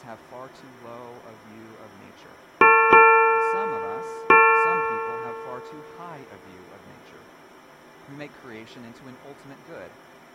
Ship's bell, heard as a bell, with speech in English. 3. Three half-hours of the watch have passed.